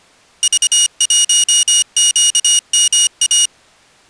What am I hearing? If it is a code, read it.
Morse code, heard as a high beeper, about 25 wpm, 2900 Hz. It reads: V1QMA